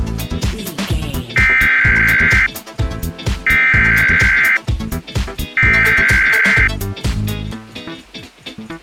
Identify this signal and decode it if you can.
Emergency Alert System (SAME) tones (header bursts), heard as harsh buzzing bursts, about 520.83 baud.